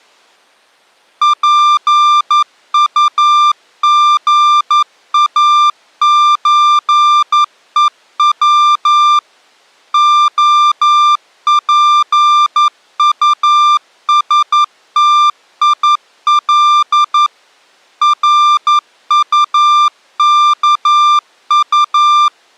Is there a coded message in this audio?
Yes: Morse code (Russian alphabet) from 1.2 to 22.3 s, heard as a keyed tone, machine-sent, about 11 wpm, 1190 Hz. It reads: ПУГАЧЕВ ОПУСТИЛ РУКУ